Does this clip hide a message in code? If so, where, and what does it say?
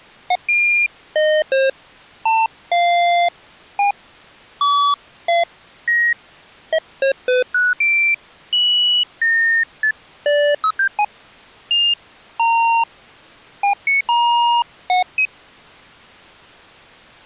No, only electronic bleeps of random pitch and length.